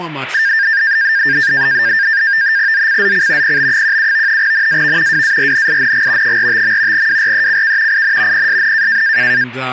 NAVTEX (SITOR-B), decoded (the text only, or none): ZCZC PB17 NAV WARNING 45. WRECK IN PSN